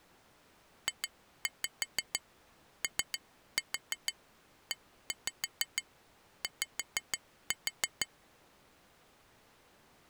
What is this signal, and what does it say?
Tap code, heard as taps on glass, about 6 knocks a second. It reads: JOEY